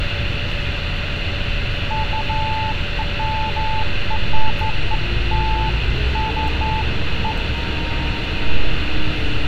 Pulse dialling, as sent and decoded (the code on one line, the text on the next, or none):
none